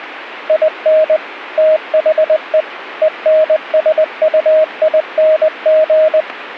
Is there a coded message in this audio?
Yes: Morse code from 0.4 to 6.3 s, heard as a keyed tone, machine-sent, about 20 wpm, 630 Hz. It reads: IN THE ENSUING